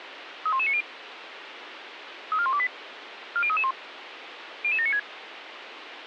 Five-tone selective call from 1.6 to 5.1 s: 34128 40331 00796

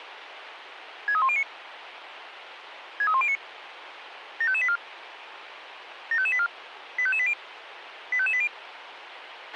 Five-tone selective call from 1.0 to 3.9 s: 63109 63109

